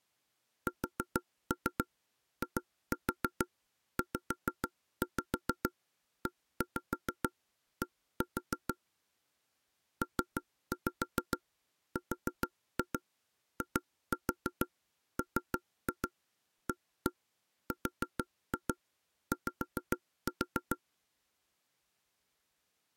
Tap code, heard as knocks on wood, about 6 knocks a second. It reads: SIZED PRIMARY